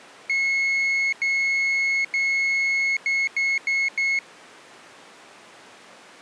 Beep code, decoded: 3 long, 4 short

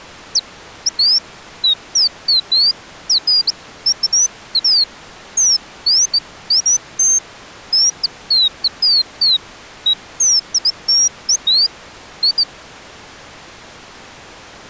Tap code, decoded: none

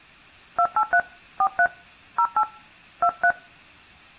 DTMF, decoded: 283 43 08 23

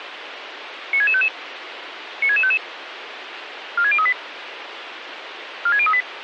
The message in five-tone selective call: 96655 96655 46038 46038

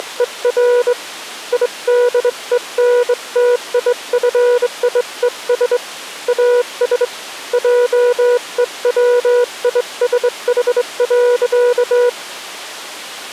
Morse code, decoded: … IDENTIFIES AS JEWISH.

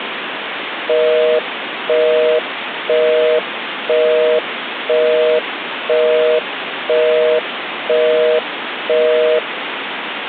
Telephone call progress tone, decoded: busy tone

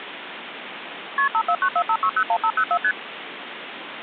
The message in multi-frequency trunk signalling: KP 54945601504 ST

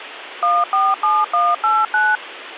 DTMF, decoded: 147189

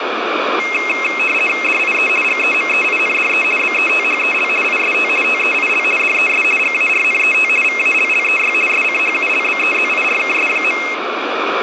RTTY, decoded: DIE GEMEINDE BETHEL IST TEIL DES GARNET VALLEY SCHULBEZIRKS.

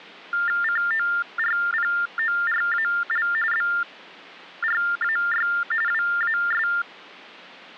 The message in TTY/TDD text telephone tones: CORPORAL BRAY WAS

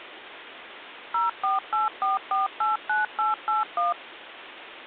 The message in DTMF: 0484489881

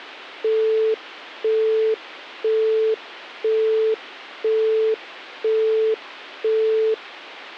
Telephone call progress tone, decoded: busy tone

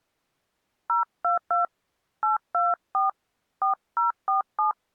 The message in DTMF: 022 824 4047

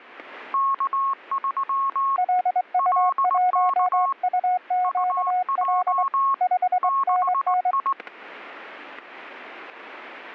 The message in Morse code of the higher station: K3 LK UJ 6I

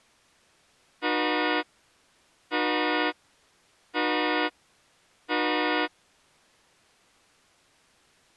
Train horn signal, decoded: 4 short

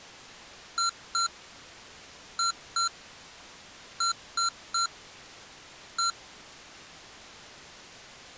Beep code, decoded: 2-2-3-1

